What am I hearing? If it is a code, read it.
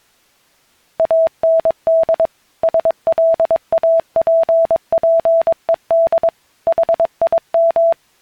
Morse code, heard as a keyed tone, machine-sent, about 22 wpm, 660 Hz. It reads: AND SLAPPED HIM